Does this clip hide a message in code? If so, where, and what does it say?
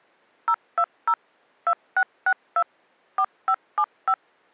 Yes: DTMF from 0.5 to 4.1 s, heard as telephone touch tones, dialled by machine, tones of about 60 ms. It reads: 020 2662 4575